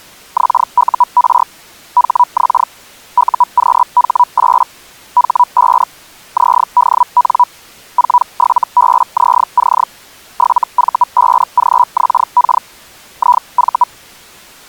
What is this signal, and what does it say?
Hellschreiber (Feld-Hell, 122.5 baud), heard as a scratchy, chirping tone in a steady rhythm, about 980 Hz. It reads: XUR HX UQH8 H5 ZDN 47BZC 7V5GXK IV